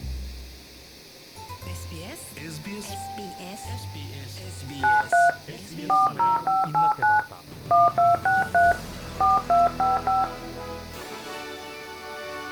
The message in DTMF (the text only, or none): 93 40589 1263 4255